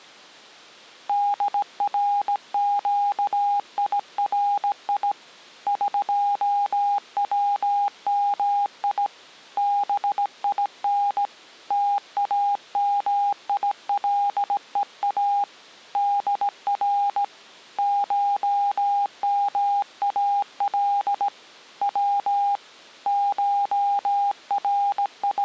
Morse code (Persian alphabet), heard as a keyed tone, hand-sent with a straight key, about 17 wpm, 810 Hz. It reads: درگیری قومی بین تامیلها در شمال و …